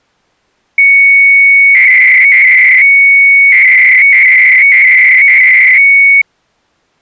300-baud modem data (Bell 103 tones), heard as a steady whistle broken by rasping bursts, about 300 baud, 200 Hz shift.